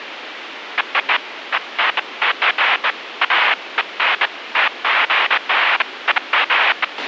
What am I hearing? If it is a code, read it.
Bursts of noise, with radio hiss and a squelch burst at the end. There is no code.